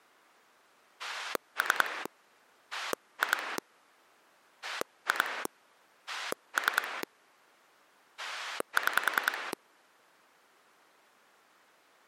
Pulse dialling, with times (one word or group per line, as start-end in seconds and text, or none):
1.0-2.1 3
2.7-3.6 2
4.6-5.5 2
6.1-7.0 3
8.2-9.5 6